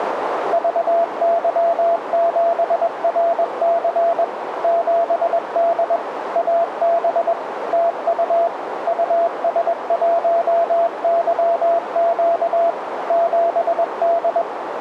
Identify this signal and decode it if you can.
Morse code, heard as a keyed tone, machine-sent, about 21 wpm, 680 Hz, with radio static and a narrow filter. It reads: VY7RC 7D AB TU US1YQ 7D